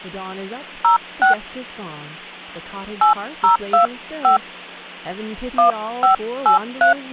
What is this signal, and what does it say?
DTMF, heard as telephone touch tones, dialled by hand, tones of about 120 ms, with speech in English. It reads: 06 8025 1583